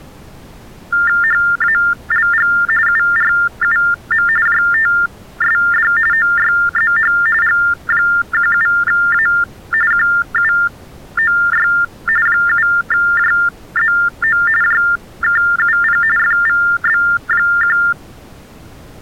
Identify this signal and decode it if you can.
TTY/TDD text telephone tones (45.45 baud Baudot), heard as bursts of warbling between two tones, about 400 Hz shift, 1600 Hz centre. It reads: HALG URUM JTSD OYZH G17A QUOY 7JZO JKUP FVB1